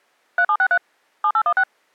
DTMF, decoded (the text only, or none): 3763 7816